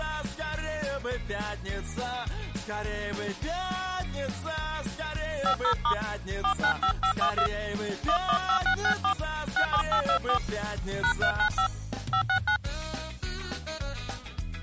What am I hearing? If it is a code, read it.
DTMF, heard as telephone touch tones, dialled by hand, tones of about 90 ms. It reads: 50* 495512 115664 67824 #395 569